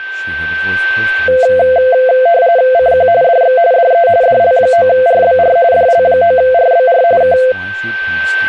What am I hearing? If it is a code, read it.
RTTY (45.45 baud, 170 Hz shift), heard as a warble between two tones, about 600 Hz centre, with a steady whistle near 1550 Hz and speech in English. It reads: CQ DX DE DL9RBR DL9RBR K